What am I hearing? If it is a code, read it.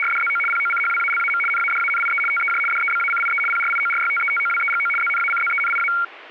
RTTY (75 baud, 850 Hz shift), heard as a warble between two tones, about 1800 Hz centre. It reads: … POCHWALAM NADANIE TEJ DEBACIE PRIORYTETOWEGO ZNACZENIA